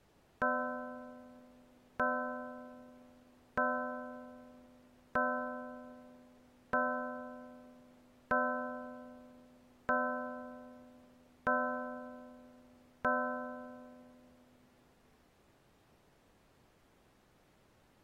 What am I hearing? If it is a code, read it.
Clock strike, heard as a bell. 9. Nine o'clock.